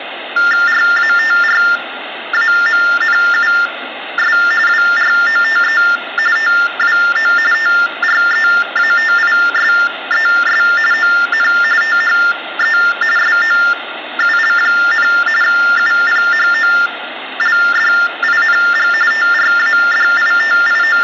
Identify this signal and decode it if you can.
TTY/TDD text telephone tones (45.45 baud Baudot), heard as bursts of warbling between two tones, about 400 Hz shift, 1600 Hz centre, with phone line noise. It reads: RATRAMNUS WROTE TWO TREATISES ON THE SOUL, UPHOLDING …